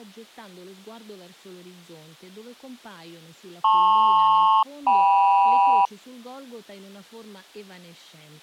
Aircraft SELCAL, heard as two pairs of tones. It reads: LP-KM